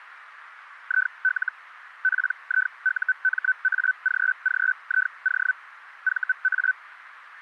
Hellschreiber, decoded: IL PIUMAGGIO VA

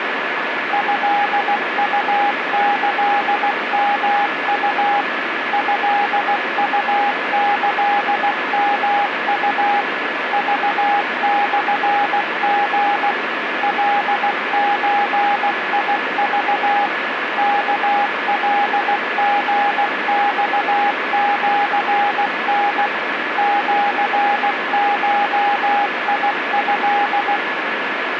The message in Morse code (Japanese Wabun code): トウキヨウ トウキヨウ クモリ カゾク ワカリマシタ シゴト

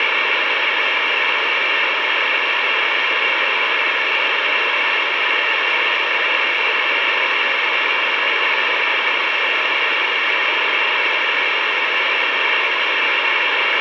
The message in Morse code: BEHIND

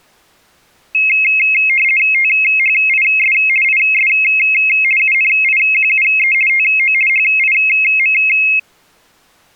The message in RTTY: THIS IS UNIQUE TO HIM

